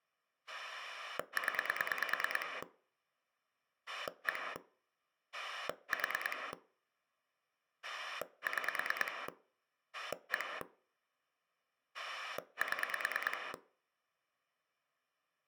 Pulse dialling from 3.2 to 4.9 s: 1

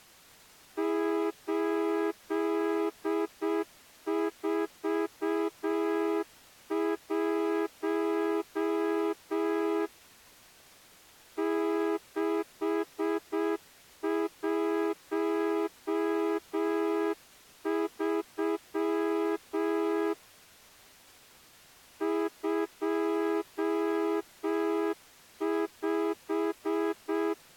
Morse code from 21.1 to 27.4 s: 25

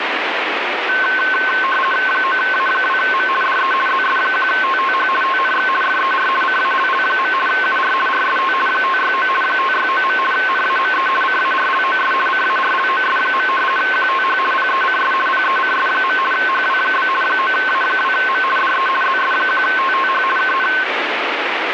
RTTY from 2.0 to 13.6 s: 9A2M DE ZS1TTH TNX FER CALL. UR RST 569 569. NAME CARLOS CARLOS.

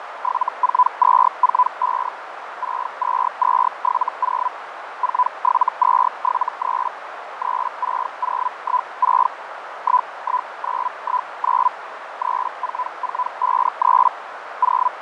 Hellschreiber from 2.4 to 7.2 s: 62270 47273

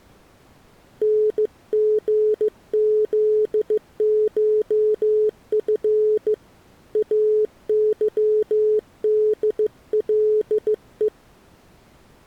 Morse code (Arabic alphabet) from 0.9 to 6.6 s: نغذشف

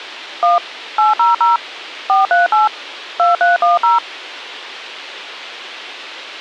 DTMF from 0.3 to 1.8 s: 1 800

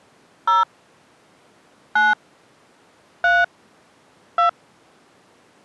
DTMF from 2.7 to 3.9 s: 3

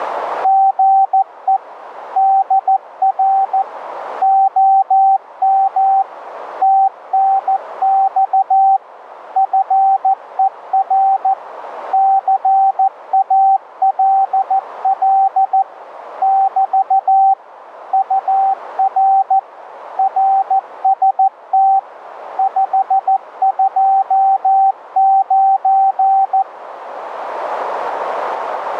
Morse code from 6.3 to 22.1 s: TNX FER CALL <BT> UR RST

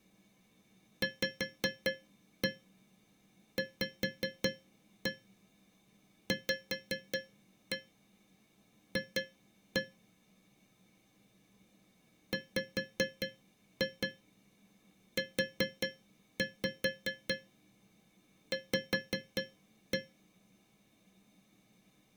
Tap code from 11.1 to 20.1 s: WUV

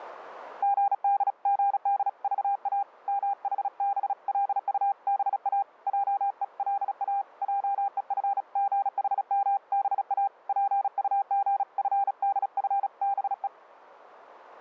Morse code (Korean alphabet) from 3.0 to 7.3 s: 묻기도 하고

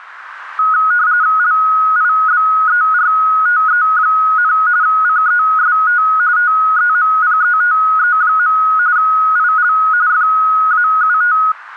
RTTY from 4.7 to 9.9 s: CEST TEMPETE. IL

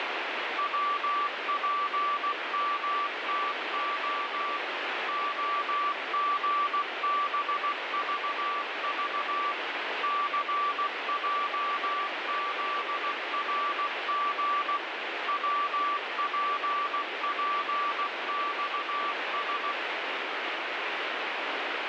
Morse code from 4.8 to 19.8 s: OGBVV CJZRG WPPXS

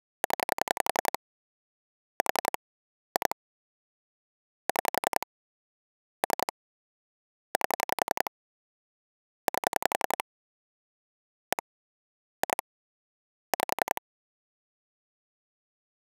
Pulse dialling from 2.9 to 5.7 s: 2 6

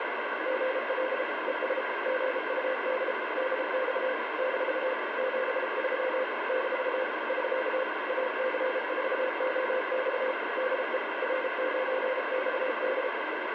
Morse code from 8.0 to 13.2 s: AC4OX DE R9XD

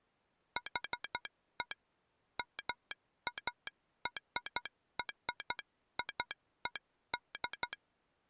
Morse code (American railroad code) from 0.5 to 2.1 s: HE

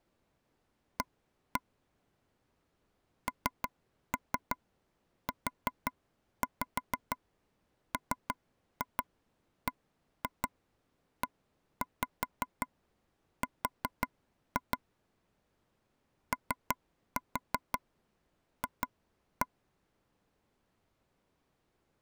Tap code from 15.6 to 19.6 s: OF

